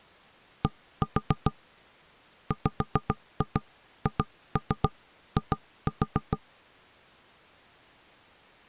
Tap code, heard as knocks on wood, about 7 knocks a second. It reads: D WHI